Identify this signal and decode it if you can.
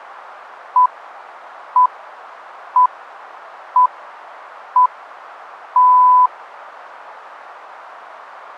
Radio time signal (six pips, as the Greenwich Time Signal), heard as pips.